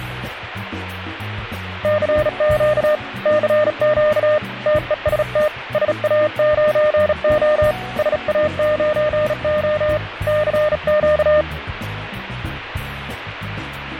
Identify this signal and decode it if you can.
Morse code, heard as a keyed tone, hand-sent with a bug key, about 36 wpm, 610 Hz, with radio static. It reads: CQ CQ TEST SA9O SA9O CQ